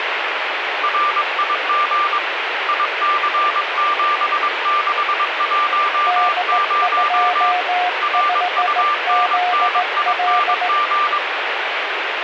Morse code, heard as two keyed tones, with radio static. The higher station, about 22 wpm, 1180 Hz: RIG IC7610 RUNNING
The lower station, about 17 wpm, 720 Hz: D25ZL